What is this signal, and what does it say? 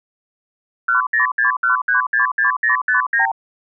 Multi-frequency trunk signalling (R2, with the far end's replies), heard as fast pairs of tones, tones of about 120 ms. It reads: 1061366059